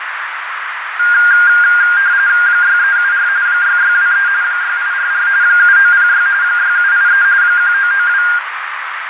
RTTY (45.45 baud, 170 Hz shift), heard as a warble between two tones, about 1500 Hz centre, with radio static, fading and a narrow filter. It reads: 6374 6623 6844 7906 6783 1992